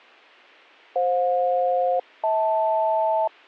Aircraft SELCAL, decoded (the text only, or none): FJ-HL